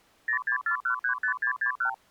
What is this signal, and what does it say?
Multi-frequency trunk signalling (R2, with the far end's replies), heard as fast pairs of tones, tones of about 100 ms. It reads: 064135661